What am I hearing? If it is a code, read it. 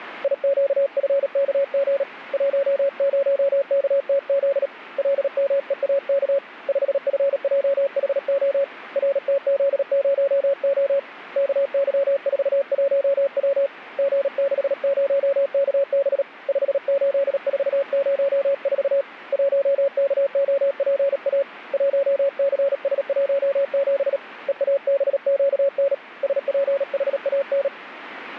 Morse code, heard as a keyed tone, hand-sent with a paddle, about 37 wpm, 560 Hz. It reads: IQFKG 10KTZ LMEAK 5FJHO RTZ0O KY41W G60KB 58404 1KOPA 1CS17 EABQN SPHAN